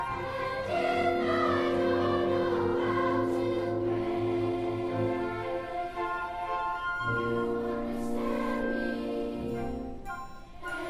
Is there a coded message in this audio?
No.